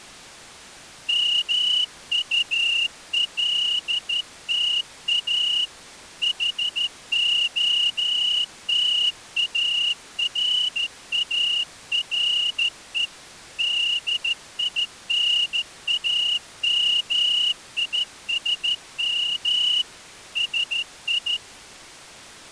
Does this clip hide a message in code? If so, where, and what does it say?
Yes: Morse code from 1.0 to 21.4 s, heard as a whistle, hand-sent with a straight key, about 13 wpm. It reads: MULTA HOTARARE DINAMISM SI